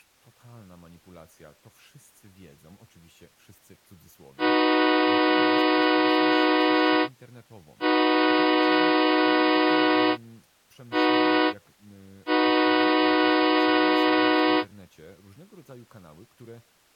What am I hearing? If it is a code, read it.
Train horn signal, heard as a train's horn, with speech in Polish. 2 long, 1 short, 1 long. On North American railways: approaching a public crossing.